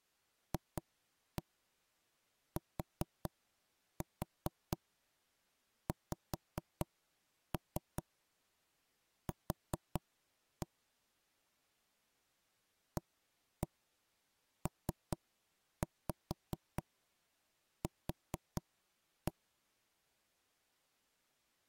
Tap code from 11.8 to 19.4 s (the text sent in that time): APQ